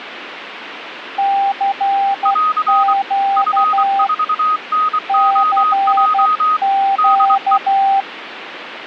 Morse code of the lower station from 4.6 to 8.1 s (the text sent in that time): CQ